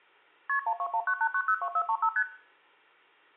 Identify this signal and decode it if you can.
Multi-frequency trunk signalling (R1, as on North American trunks), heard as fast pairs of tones, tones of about 70 ms, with hum and room echo. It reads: KP 12198902435 ST